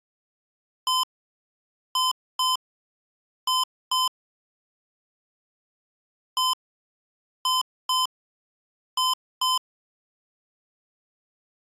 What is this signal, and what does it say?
Beep code, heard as beeps from a small speaker, played twice, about 1020 Hz. 1-2-2. In Phoenix BIOS tables: DMA initialisation failure.